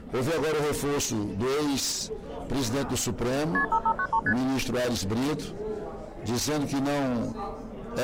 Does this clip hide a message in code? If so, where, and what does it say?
Yes: multi-frequency trunk signalling (R1, as on North American trunks) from 3.5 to 4.3 s, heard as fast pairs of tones, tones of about 70 ms. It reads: KP 5593 ST